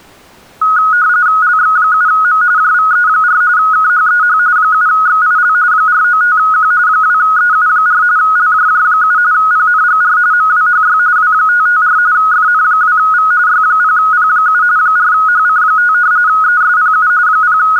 RTTY (45.45 baud, 170 Hz shift), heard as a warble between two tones, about 1360 Hz centre. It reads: LX7M JVE4 KHEH 7XIL 495Q 2EU4 LJJ7 PNGR MWHY W554 FN2V Y0P7 4HC5 ESPU …